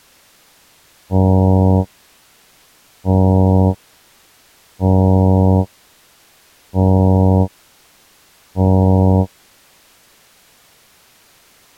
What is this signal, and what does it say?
Ship horn signal, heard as a ship's horn, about 90 Hz. 5 short. At sea: I doubt that you are doing enough to avoid a collision.